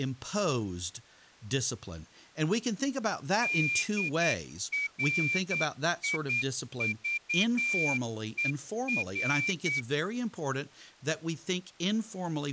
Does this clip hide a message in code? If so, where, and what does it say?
Yes: Morse code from 3.4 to 9.9 s, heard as a whistle, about 9 wpm, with speech in English. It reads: DRIVER